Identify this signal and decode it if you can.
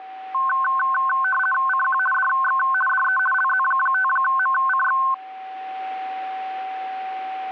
RTTY (50 baud, 450 Hz shift), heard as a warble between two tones, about 1290 Hz centre, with a steady whistle near 760 Hz. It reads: CQ DX DE LZ5MCX